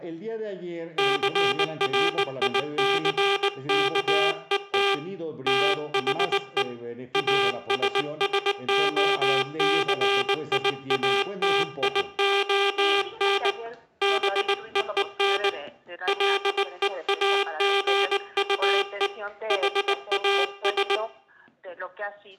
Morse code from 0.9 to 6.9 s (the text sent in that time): CRICKET THE